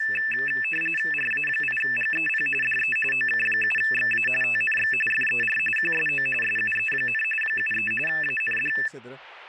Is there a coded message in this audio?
Yes: RTTY (45.45 baud, 850 Hz shift) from 0.0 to 8.9 s, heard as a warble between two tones, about 2200 Hz centre, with static crashes and speech in Spanish. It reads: RA8GEP DE OK7XA TNX FER QSO SUE, 73 AND